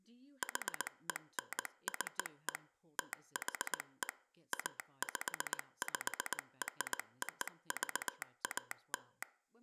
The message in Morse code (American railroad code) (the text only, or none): HENCE THE APPROVAL